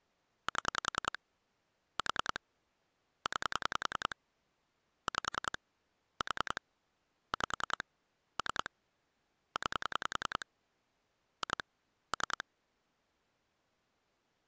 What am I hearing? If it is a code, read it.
Pulse dialling, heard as clicks on a phone line, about 10 pulses a second. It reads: 7 4 9 5 4 5 3 9 2 3